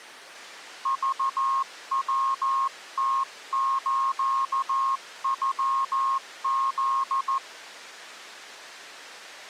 Morse code (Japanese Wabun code), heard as a keyed tone, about 14 wpm, 1080 Hz. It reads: クヤムスノフ